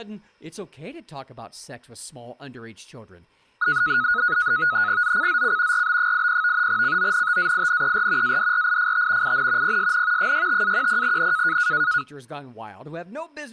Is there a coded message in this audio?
Yes: NAVTEX (SITOR-B), 100 baud, 170 Hz shift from 3.6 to 12.0 s, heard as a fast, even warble, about 1360 Hz centre, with speech in English. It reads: ZCZC RB80 CONTAINER ADRIFT IN PSN 65-10N